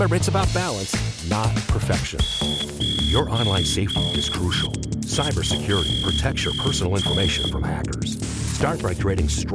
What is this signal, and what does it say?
Morse code, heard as a whistle, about 7 wpm, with room echo. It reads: 92